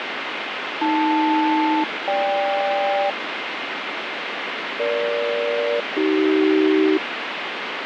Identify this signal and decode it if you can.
Aircraft SELCAL, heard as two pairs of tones, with radio static. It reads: AL-GK EG-AC